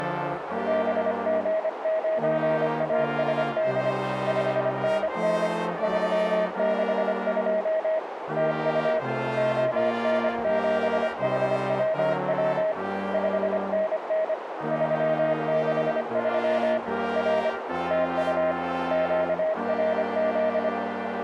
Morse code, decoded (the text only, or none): BG9ASD 5NN 362 TU ON7HWW 5NN 363 R TU QRZ